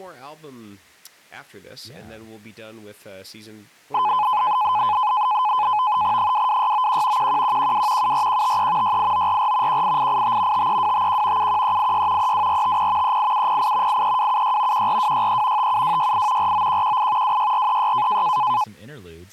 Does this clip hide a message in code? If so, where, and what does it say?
Yes: NAVTEX (SITOR-B), 100 baud, 170 Hz shift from 3.9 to 18.6 s, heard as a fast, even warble, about 930 Hz centre, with speech in English. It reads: 22691 11112 74153 68944 18885 53251 71386 32450 38708 83276 14263 57268 49118 26436